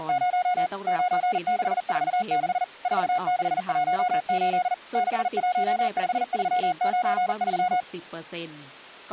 Morse code, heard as a keyed tone, machine-sent, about 40 wpm, 720 Hz, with speech in Thai. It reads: … 9646 4618 615393